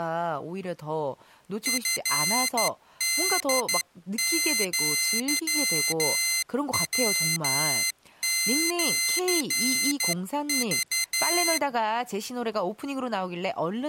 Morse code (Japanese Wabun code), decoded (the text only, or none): チホアヤシク